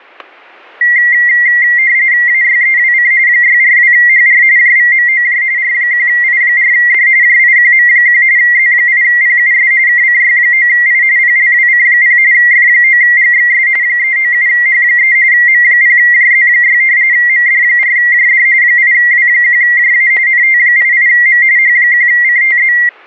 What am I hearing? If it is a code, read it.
RTTY (45.45 baud, 170 Hz shift), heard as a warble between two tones, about 2000 Hz centre, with static crashes. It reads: AYEWC 642HR JVMOJ R1I4D JIQM1 Z8PUS KCY9I PLWC0 F9GXS 397H3 M0JZ6 MD4JD 8W1JA NT88M H1CTZ